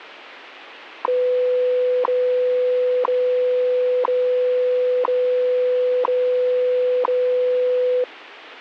Radio time signal (WWV, Colorado), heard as ticks, one a second.